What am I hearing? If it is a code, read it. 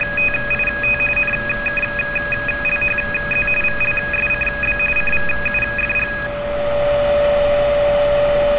RTTY (45.45 baud, 850 Hz shift), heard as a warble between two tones, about 2100 Hz centre, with a steady whistle near 580 Hz and street noise. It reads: … NKLHZ VLSCB CVUFG